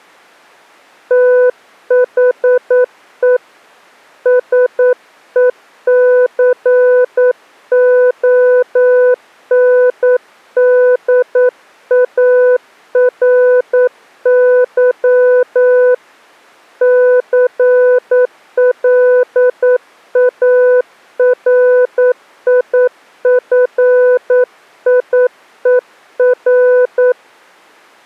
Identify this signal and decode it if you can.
Morse code, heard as a keyed tone, hand-sent with a paddle, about 9 wpm, 500 Hz. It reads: THE SECONDARY CLARIFIER